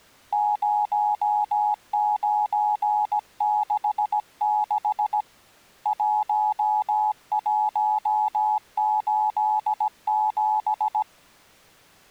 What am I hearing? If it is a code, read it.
Morse code, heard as a keyed tone, hand-sent with a paddle, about 17 wpm, 850 Hz. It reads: 0966 1187